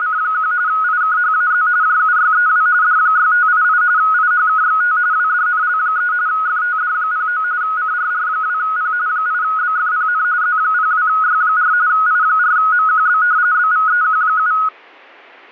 RTTY (45.45 baud, 170 Hz shift), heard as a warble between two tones, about 1360 Hz centre. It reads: … IKHAZ JUYEW D6588 IHKXT WDNL3 FTD09 CRR2P 8BFPN Z02Y4 I4MQB BVEQ7